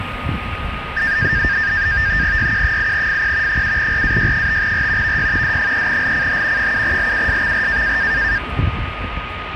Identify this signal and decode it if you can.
NAVTEX (SITOR-B), 100 baud, 170 Hz shift, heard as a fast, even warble, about 1700 Hz centre, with radio static, a steady whistle near 1240 Hz and street noise. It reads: YQ8FP 7RAY5R VY D3LCH 7LUSXR